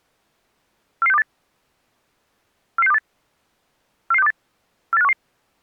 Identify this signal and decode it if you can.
Five-tone selective call (EEA), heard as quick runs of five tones, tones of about 40 ms. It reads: 44628 44628 44628 48511